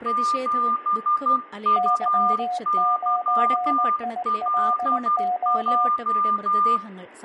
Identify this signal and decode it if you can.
Morse code, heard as two keyed tones, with room echo and speech in Malayalam. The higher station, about 12 wpm, 1200 Hz: 7UYLJ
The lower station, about 19 wpm, 720 Hz: Y9ILO